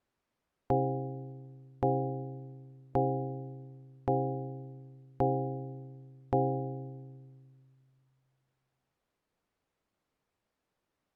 Clock strike, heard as a bell. 6. Six o'clock.